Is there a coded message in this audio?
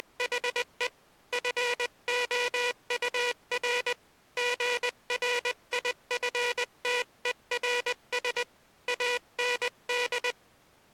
Yes: Morse code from 0.0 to 10.4 s, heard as a buzzer, hand-sent with a paddle, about 20 wpm. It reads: … FOUR GRIFTERS AND